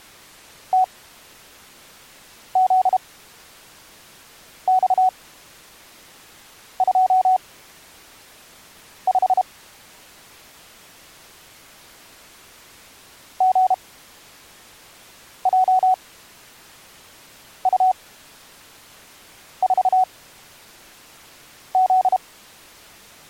Morse code, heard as a keyed tone, machine-sent, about 32 wpm, spaced as for 5 wpm, 750 Hz. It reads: TZX25 GJU4Z